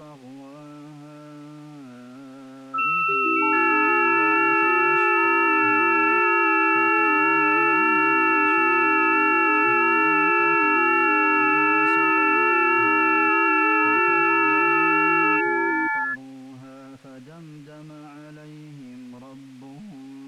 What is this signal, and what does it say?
FT8 (several signals at once), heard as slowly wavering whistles, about 6.25 baud.